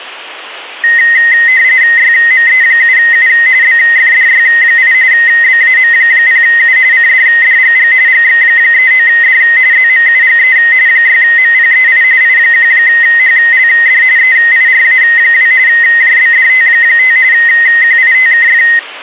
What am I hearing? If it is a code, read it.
RTTY (45.45 baud, 170 Hz shift), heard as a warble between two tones, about 1950 Hz centre. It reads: YME7U BFDY8 BAM0U CDDGG GX39D ZMUGE 6MPEI I1HLD EIRA2 JBDT5 QITKF